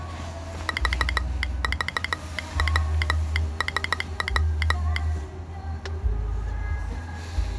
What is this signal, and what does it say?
Morse code, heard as a telegraph sounder, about 15 wpm, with the noise inside a car. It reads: VVWSW